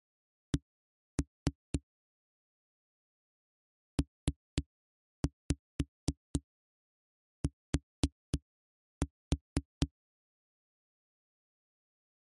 Tap code, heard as knocks on a wall, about 4 knocks a second. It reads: C PT